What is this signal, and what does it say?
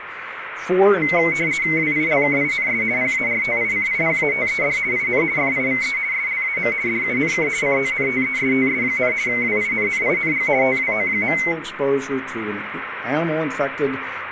RTTY (50 baud, 170 Hz shift), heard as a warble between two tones, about 2150 Hz centre, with radio static. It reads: WILKINS PARTICIPATED IN FIVE SLAM DUNK CONTESTS, WINNING TWO.